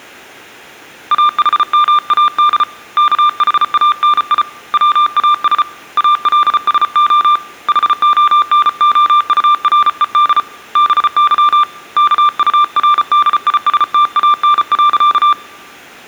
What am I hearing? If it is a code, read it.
Morse code, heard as a keyed tone, hand-sent with a paddle, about 34 wpm, 1190 Hz. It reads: AHMAD KHANI WAS ALSO HONOURED BY KURDISTAN.